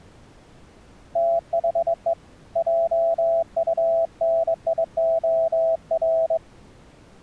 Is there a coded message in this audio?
Yes: Morse code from 1.1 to 6.4 s, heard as a keyed tone, hand-sent with a straight key, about 22 wpm, 660 Hz. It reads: THE JUNIOR